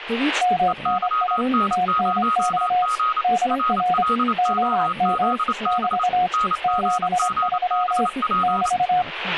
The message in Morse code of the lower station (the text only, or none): MNI TNX DR OM <BT> 73 <BT>